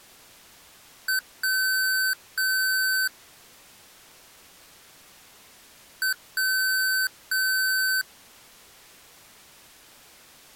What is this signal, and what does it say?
Beep code, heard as beeps from a small speaker, played twice, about 1550 Hz. 1 short, 2 long.